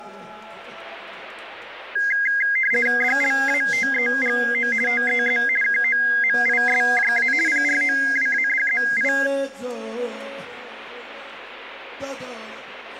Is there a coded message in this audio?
Yes: RTTY (50 baud, 450 Hz shift) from 2.0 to 9.3 s, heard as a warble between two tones, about 1850 Hz centre. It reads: DLATEGO TEZ KOMISJA PROWADZI